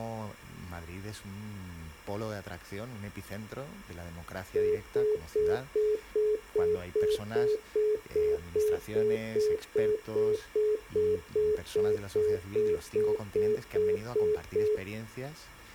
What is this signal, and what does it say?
Telephone call progress tone (single-tone plan, as in most of Europe), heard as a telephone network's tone, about 420 Hz, 0.2 s on and 0.2 s off. Congestion tone.